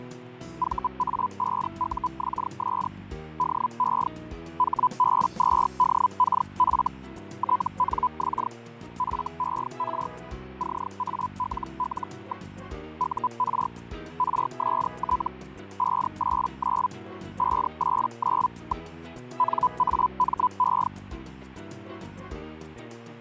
Hellschreiber (Feld-Hell, 122.5 baud), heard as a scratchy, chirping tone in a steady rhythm, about 1000 Hz, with fading. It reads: VA5UXS DE HB2DKF TNX FER CALL. UR RST 589 589. NAME